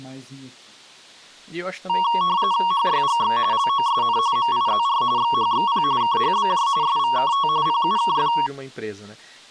RTTY (45.45 baud, 170 Hz shift), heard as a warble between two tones, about 1020 Hz centre, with speech in Portuguese. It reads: HYGX LOSN MIZR XHXP KHBJ SVKT PUKF